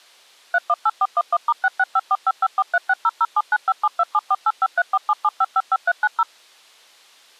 DTMF, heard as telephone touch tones, dialled by machine, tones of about 40 ms. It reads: 318411*665455436007957274853477555390